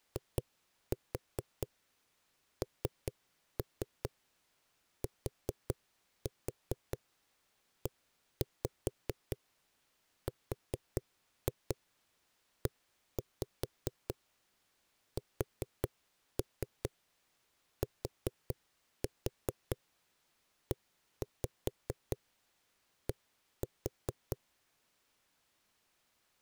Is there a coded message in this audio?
Yes: tap code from 0.2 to 24.4 s, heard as knocks on a wall, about 4 knocks a second. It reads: INTERESTED